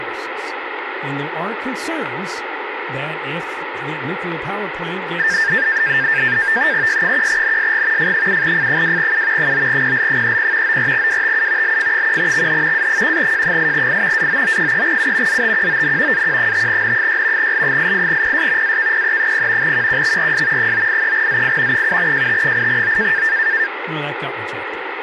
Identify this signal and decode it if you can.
NAVTEX (SITOR-B), 100 baud, 170 Hz shift, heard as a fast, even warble, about 1700 Hz centre, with radio static and speech in English. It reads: Y1NSG F7F2U 9PL30 94WTU LF1XH A1J8I AOO3U ZTQON AQ5N6 L88PS AKPE0 QQXRS 983ZI 7JT8O